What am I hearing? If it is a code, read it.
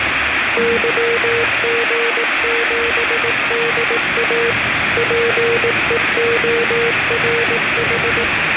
Morse code, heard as a keyed tone, machine-sent, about 18 wpm, 470 Hz, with radio static and the noise inside a lift. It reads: YG7DA PEORH